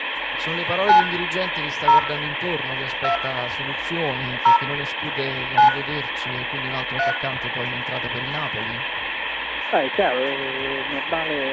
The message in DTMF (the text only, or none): 9 0 2 0 9 3